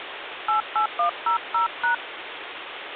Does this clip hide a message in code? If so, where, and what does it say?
Yes: DTMF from 0.5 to 1.9 s, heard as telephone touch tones, dialled by hand, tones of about 120 ms, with phone line noise. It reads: 88100#